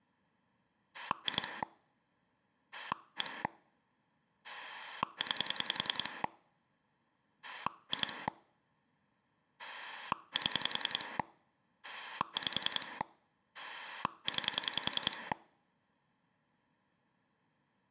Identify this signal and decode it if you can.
Pulse dialling, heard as a rotary dial, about 10 pulses a second. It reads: 2 1 9 2 7 5 9